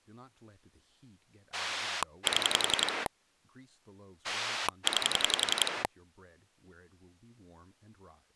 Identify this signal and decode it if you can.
Pulse dialling, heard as a rotary dial, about 11 pulses a second, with speech in English. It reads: 7 9